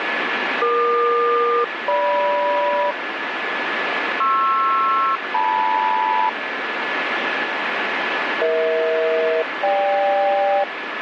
Aircraft SELCAL, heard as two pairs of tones, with radio static. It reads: EQ-GM PR-LM EH-GK